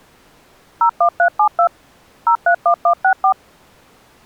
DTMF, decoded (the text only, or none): 01372 031164